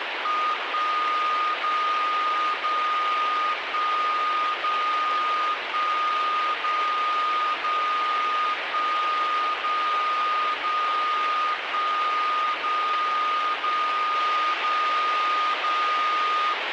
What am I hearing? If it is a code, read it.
Radio time signal (DCF77), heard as a tone whose level steps once a second, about 1230 Hz, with radio static. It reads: 1 0 0 1 0 1 0 0 1 0 0 1 0 0 0 0